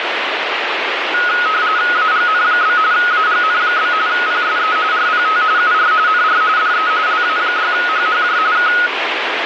RTTY (45.45 baud, 170 Hz shift), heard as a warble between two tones, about 1360 Hz centre, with radio static. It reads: AGN? AGN? PSE RPT UR NR DE LA6HHJ K